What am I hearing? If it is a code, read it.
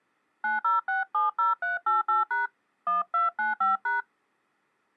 DTMF, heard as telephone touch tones, dialled by hand, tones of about 150 ms. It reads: 90670388# 1295#